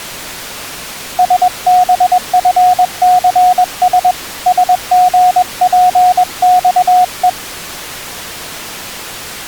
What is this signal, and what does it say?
Morse code, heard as a keyed tone, hand-sent with a paddle, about 21 wpm, 730 Hz. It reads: SBFCS SGPXE